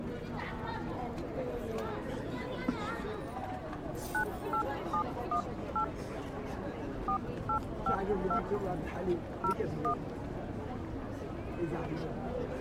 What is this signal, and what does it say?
DTMF, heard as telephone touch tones, dialled by hand, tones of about 90 ms. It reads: 98718 4852 01